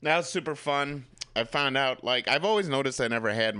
Speech in English. There is no code.